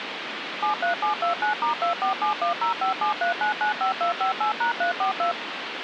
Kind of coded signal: DTMF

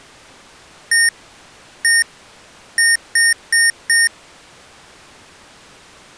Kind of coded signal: beep code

